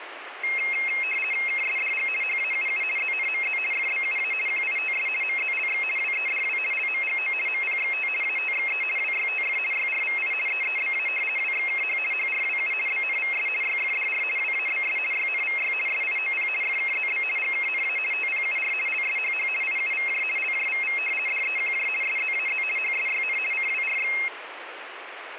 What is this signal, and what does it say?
RTTY (50 baud, 450 Hz shift), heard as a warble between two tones, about 2350 Hz centre, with radio static. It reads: KSDG HAUU ZNMZ FBUA QITS MZLX WEDW LMGO MPXT ATXE WYTF YRVI EEBA WXKH HRWU BNVS YFDR WABS YNVY SIOP FKZB GKNA TPUR LSHH IUVJ LJVV DEQJ SZAZ HSYN CWRX